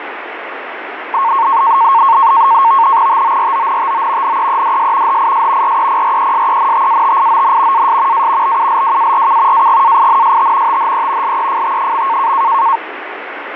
NAVTEX (SITOR-B), 100 baud, 170 Hz shift, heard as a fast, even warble, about 1000 Hz centre, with radio static. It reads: TORONTO NEEDS HIS REPRESENTATION AS A BULWARK AGAINST THE LEFT.